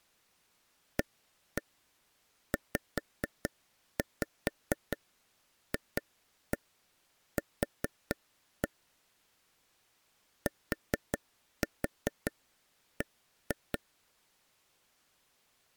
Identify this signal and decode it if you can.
Tap code, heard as taps on a table, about 4 knocks a second. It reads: AZFQ TB